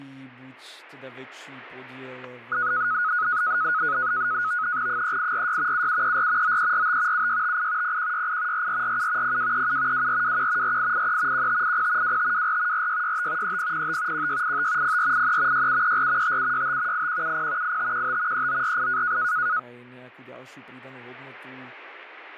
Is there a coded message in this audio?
Yes: NAVTEX (SITOR-B), 100 baud, 170 Hz shift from 2.5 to 19.6 s, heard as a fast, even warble, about 1360 Hz centre, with static crashes and speech in Slovak. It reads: 3846 7734 9345 7658 0168 4447 0237 2421 4883 1580 2524 4665 3005 1685 0483 6734 5765 8170 8515 3948